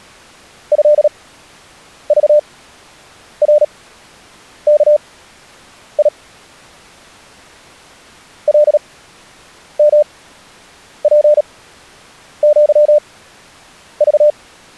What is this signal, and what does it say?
Morse code (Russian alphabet), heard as a keyed tone, machine-sent, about 37 wpm, spaced as for 8 wpm, 600 Hz. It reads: ЭЖРКИ ЛМПЪЖ